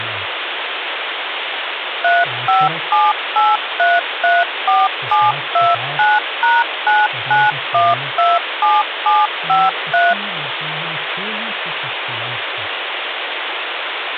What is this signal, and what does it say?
DTMF, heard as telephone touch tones, dialled by machine, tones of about 200 ms, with phone line noise. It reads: 3578334729#99127753